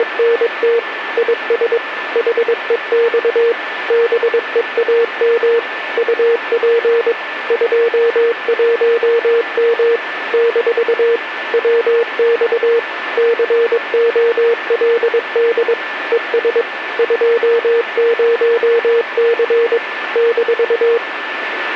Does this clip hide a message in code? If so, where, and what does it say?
Yes: Morse code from 0.0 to 21.0 s, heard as a keyed tone, machine-sent, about 22 wpm, 470 Hz, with radio static and a steady whistle near 1760 Hz. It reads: … IS HEX BEAM UP 21M - WX COLD ES 20C -